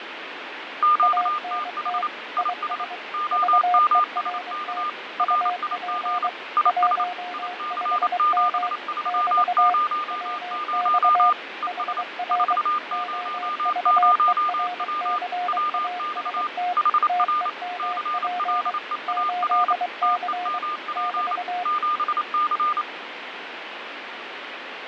Morse code, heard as two keyed tones, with radio static and fading. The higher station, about 28 wpm, 1210 Hz: QTH IS OMSK RIG IS IC7300 ES 400W WX HR CLEAR TEMP 7C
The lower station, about 23 wpm, 720 Hz: ANT IS VERT UP 15M <BT> WX HR OVERCAST TEMP 8C <BT>